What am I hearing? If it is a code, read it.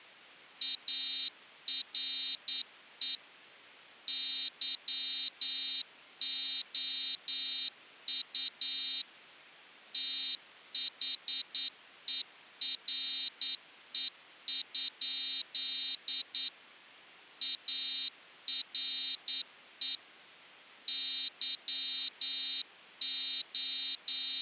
Morse code, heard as a high beeper, machine-sent, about 9 wpm, 4000 Hz. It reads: ARE YOU THERE? ARE …